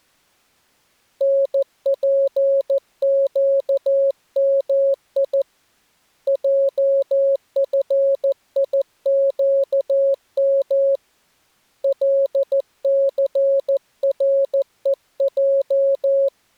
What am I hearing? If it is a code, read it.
Morse code, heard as a keyed tone, hand-sent with a paddle, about 14 wpm, 550 Hz. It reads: NPQMI JFIQM LCREJ